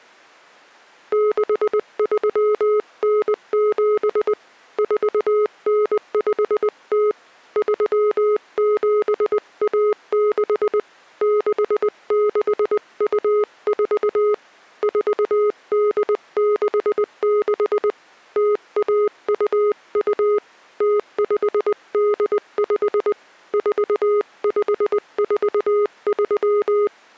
Morse code (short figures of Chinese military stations), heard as a keyed tone, hand-sent with a paddle, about 20 wpm, 420 Hz. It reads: 6397 4950 3716 6624 4866 0122 0585 4543